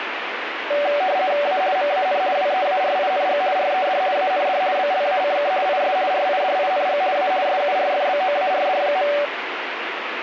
RTTY (50 baud, 170 Hz shift), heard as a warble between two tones, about 660 Hz centre, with radio static. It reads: A MAN WEARING RED AND BLACK IS RIDING A SURFBOARD.